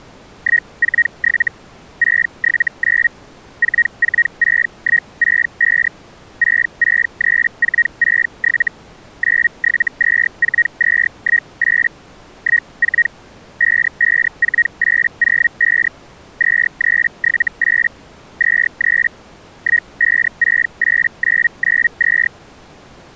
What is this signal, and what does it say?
Hellschreiber (Feld-Hell, 122.5 baud), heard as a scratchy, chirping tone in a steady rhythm, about 1900 Hz. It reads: 147 679 446165 663467 9724218 14 554805 2378 23 1568992